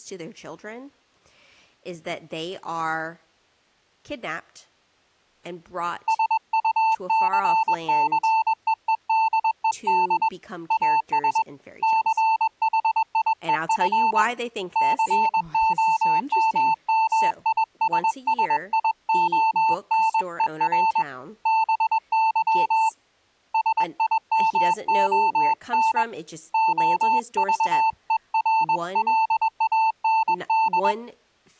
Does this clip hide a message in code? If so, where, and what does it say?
Yes: Morse code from 6.0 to 31.0 s, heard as a keyed tone, hand-sent with a paddle, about 21 wpm, 890 Hz, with speech in English. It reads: SUCCEEDED AS CHIEF COMMISSIONER BY SIMON OVERLAND